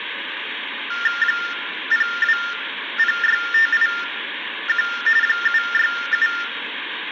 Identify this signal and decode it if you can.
TTY/TDD text telephone tones (45.45 baud Baudot), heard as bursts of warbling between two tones, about 400 Hz shift, 1600 Hz centre, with phone line noise and room echo. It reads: 0206581 767